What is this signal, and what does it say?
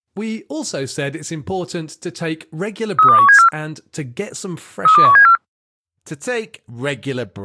Five-tone selective call (CCIR), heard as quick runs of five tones, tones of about 100 ms, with speech in English. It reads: 32174 32174